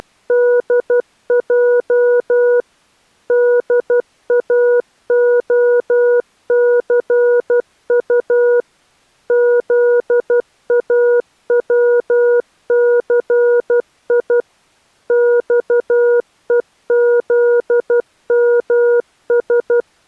Morse code, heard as a keyed tone, machine-sent, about 12 wpm, 480 Hz. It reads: … DAOCU ZAWCI XEZMS